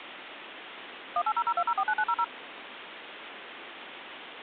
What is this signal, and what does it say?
DTMF, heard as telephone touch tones, dialled by machine, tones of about 60 ms, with phone line noise. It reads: 18002049900